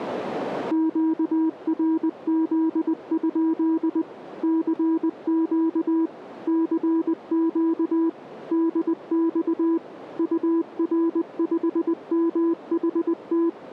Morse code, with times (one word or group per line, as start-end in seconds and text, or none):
0.7-4.0 QRZ?
4.4-6.1 CQ
6.5-8.1 CQ
8.5-9.8 DX
10.2-13.5 UR5MHT